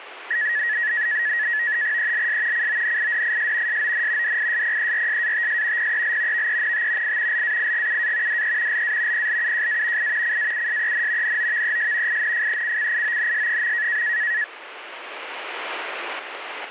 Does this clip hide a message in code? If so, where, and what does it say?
Yes: NAVTEX (SITOR-B), 100 baud, 170 Hz shift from 0.3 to 14.4 s, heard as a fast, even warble, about 1800 Hz centre. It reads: ELS CONIDIS SON DISPERSATS PEL VENT I LAIGUA DE LA PLUJA I CAUSEN NOVES INFECCIONS.